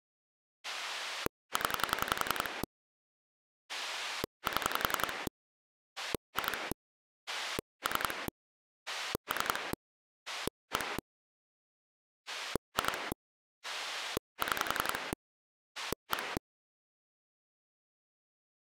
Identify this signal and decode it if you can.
Pulse dialling, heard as a rotary dial, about 11 pulses a second. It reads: 0 7 2 3 3 1 2 6 1